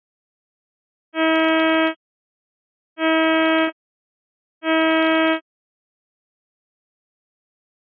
Ship horn signal, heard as a ship's horn, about 320 Hz. 3 short. At sea: I am operating astern propulsion.